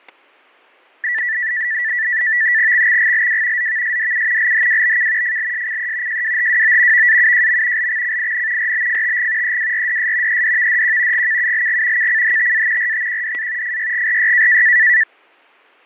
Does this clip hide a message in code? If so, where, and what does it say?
Yes: NAVTEX (SITOR-B), 100 baud, 170 Hz shift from 1.0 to 15.0 s, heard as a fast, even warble, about 1850 Hz centre, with fading and static crashes. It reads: XXGLW ZVSDU LHWBK FLSCE JWHWO VAUJM LXCIN RBFTG EWRDS EDVDQ GKULG KCHTA RTQDA FYGRY